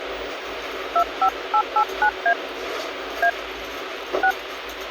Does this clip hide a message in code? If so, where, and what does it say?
Yes: DTMF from 1.0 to 4.3 s, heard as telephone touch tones, dialled by hand, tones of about 80 ms, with phone line noise and the noise inside a bus. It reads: 25889A A 6